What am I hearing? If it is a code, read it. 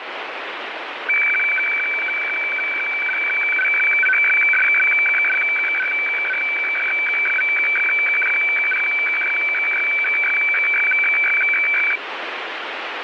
Weather fax (radiofax), 120 lines a minute, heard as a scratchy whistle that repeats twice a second, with radio static.